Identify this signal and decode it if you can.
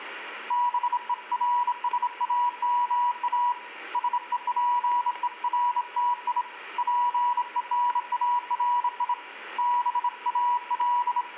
Morse code, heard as a keyed tone, hand-sent with a bug key, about 26 wpm, 970 Hz, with room echo. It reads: BERSAMA SEPERTI PENARI …